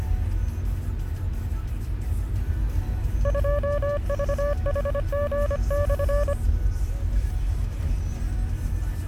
Morse code, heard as a keyed tone, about 25 wpm, 580 Hz, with the noise inside a car. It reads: 2VHG/